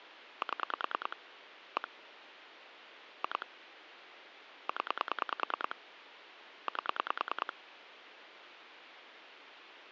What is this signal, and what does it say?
Pulse dialling, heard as clicks on a phone line, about 10 pulses a second, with phone line noise. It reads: 7 1 2 0 8